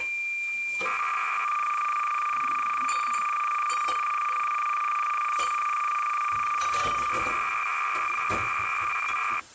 Cassette data (Kansas City type), 300 baud, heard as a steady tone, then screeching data, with kitchen noise.